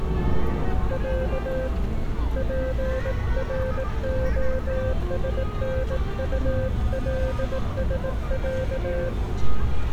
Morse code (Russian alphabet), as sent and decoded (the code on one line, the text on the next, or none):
.-.- / .--. .-. --- ... -. ..- .-.. ... .-.-
Я ПРОСНУЛСЯ